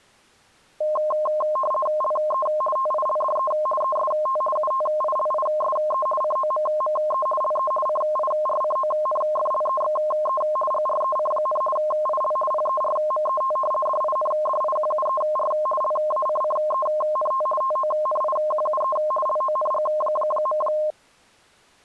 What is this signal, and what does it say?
RTTY (50 baud, 450 Hz shift), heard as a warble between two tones, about 840 Hz centre. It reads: LE TILDE EST UTILISE COMME LE CIRCONFLEXE GREC, IL PERMET DINDIQUER LACCENT TONIQUE LONG.